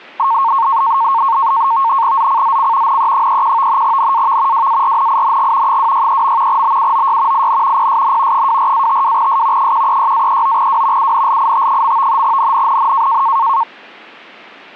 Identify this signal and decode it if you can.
NAVTEX (SITOR-B), 100 baud, 170 Hz shift, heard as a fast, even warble, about 1000 Hz centre. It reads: ZCZC NE31 NAV WARNING 263. BUOY IN PSN 24-52S 136-39W UNLIT. NNNN